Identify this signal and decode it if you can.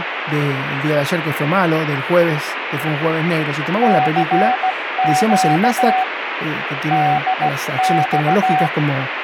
Morse code, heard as a keyed tone, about 16 wpm, 750 Hz, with radio static and speech in Spanish. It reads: CQ DX